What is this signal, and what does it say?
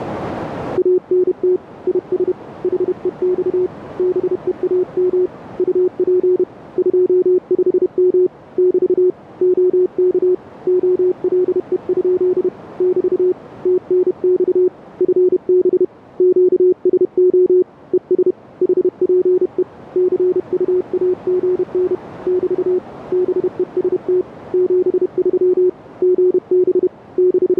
Morse code, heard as a keyed tone, hand-sent with a paddle, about 31 wpm, 360 Hz, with radio static. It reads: ANT IS HEX BEAM UP 25M <BT> OK OLE? <BT> TNX FB QSO ES HPE CUAGN <BT> BEST 73 GB …